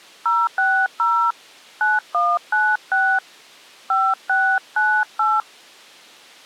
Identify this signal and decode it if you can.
DTMF, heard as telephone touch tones, dialled by hand, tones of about 240 ms. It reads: 060 9196 5698